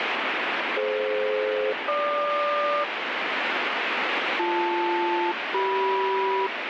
Aircraft SELCAL, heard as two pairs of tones, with heavy radio static. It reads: DF-GQ BL-CM